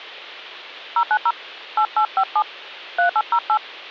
DTMF, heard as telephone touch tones, dialled by hand, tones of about 80 ms, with hum. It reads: 090 8857 3808